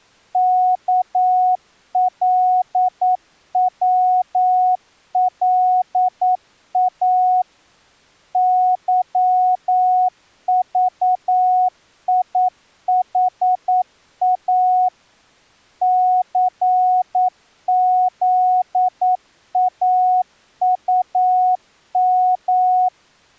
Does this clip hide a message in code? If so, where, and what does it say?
Yes: Morse code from 0.3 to 22.9 s, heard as a keyed tone, machine-sent, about 9 wpm, 740 Hz. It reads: KLWLA YVIHA CZAUM